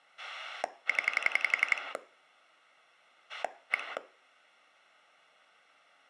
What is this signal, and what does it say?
Pulse dialling, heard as a rotary dial, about 11 pulses a second, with room echo. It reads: 0 1